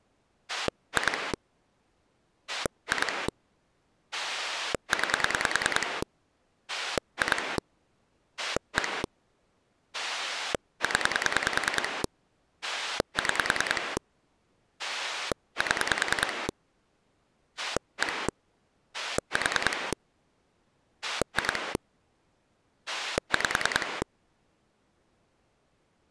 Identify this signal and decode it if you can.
Pulse dialling, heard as a rotary dial, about 10 pulses a second. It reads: 2 2 9 2 1 0 6 7 1 4 2 5